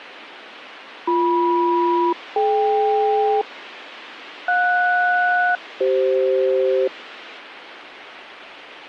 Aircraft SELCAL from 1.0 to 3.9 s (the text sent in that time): BM-DK